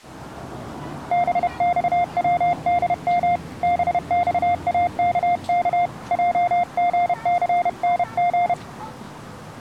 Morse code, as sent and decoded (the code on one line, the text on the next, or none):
-... -..- .-- -.. -- / -... -..- .- -.- -.- / .--- --. -.-. -. --.
BXWDM BXAKK JGCNG